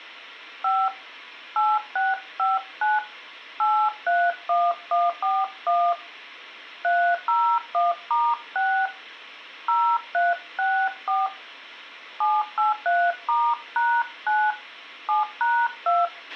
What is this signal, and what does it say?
DTMF, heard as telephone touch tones, dialled by hand, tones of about 220 ms, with a squelch burst at the end. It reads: 5 8659 831141 301*6 0364 783*#9 7#2